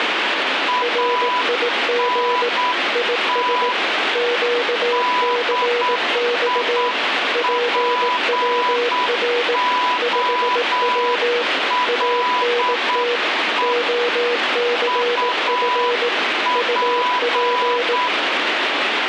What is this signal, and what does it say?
Morse code, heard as two keyed tones, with radio static. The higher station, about 8 wpm, 990 Hz: ANT DIPOLE UP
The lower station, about 18 wpm, 480 Hz: RIG IS QCX PWR 5W ANT OCF UP